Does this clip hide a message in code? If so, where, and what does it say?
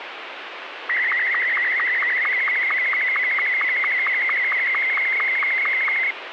Yes: SSTV (slow-scan television), Martin M2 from 0.9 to 6.1 s, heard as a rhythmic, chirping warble, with radio static.